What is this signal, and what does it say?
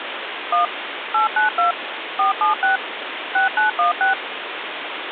DTMF, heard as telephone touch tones, dialled by machine, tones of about 130 ms, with phone line noise. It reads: 1 892 476 6916